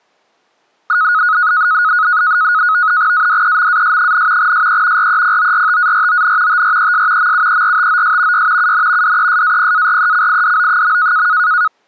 NAVTEX (SITOR-B), 100 baud, 170 Hz shift, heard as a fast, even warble, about 1360 Hz centre. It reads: ADEMAS, SE REPORTARON TRES MUERTOS Y UN DESAPARECIDO.